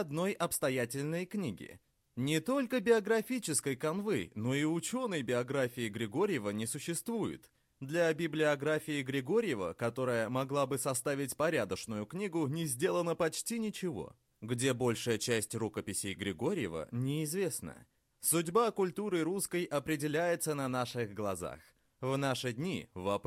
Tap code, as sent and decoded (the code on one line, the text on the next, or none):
none